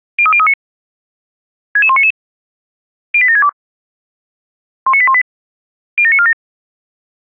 Five-tone selective call (ZVEI), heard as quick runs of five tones, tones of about 70 ms. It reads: 03039 66199 08762 19818 07947